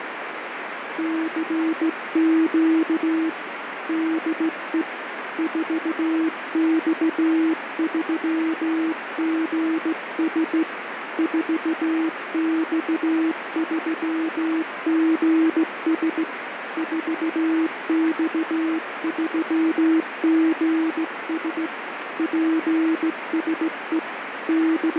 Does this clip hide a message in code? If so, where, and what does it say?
Yes: Morse code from 0.9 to 25.0 s, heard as a keyed tone, hand-sent with a straight key, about 16 wpm, 320 Hz, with radio static. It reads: CQ DE 4X3GS 4X3GS 4X3GS PSE …